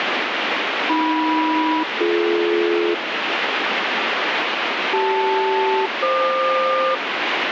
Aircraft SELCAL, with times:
0.9-2.9 AM-BD
4.9-6.9 CL-FQ

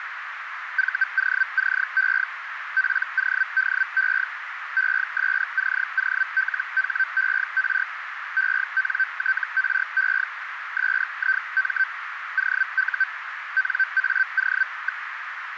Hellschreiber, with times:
0.8-2.2 VOCE
2.8-4.2 PODE
4.8-7.8 ESCOLHER
8.4-10.2 ENTRE
10.8-11.8 SIM
12.4-13.0 OU
13.6-15.0 NAO.

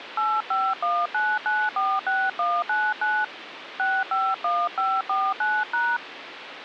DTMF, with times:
0.2-3.2 8519946199
3.8-6.0 651549#

